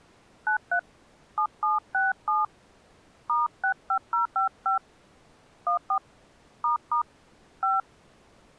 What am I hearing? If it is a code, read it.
DTMF, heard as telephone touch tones, dialled by hand, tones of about 130 ms. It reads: 93 7767 *65055 14 ** 5